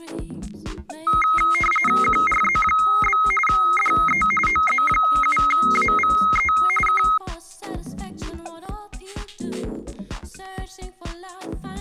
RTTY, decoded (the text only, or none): QRZ? DE OZ7AVE K